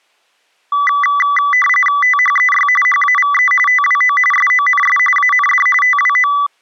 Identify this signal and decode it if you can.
RTTY (45.45 baud, 850 Hz shift), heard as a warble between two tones, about 1550 Hz centre. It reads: THEY HAVE TWO SONS AND TWO